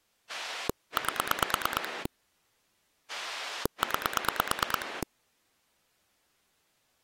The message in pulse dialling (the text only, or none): 8 9